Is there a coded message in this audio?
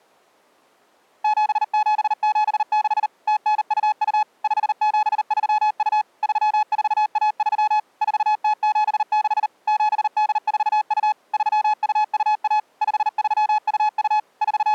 Yes: Morse code (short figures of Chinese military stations) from 1.2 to 14.7 s, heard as a keyed tone, machine-sent, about 39 wpm, 850 Hz. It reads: 7776 0922 5732 3413 4076 7842 3221 5322 …